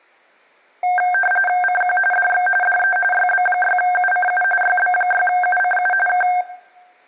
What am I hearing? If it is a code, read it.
RTTY (45.45 baud, 850 Hz shift), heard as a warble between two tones, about 1150 Hz centre, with room echo. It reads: CQ DX DE YB6UCU YB6UCU K